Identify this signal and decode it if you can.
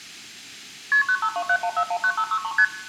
Multi-frequency trunk signalling (R1, as on North American trunks), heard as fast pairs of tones, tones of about 70 ms, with room echo. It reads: KP 95271419563 ST